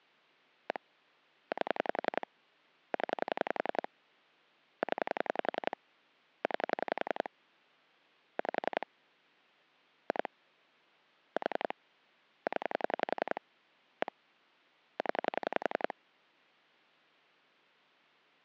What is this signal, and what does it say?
Pulse dialling, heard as clicks on a phone line, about 11 pulses a second. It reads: 1 8 0 0 9 5 2 4 0 1 0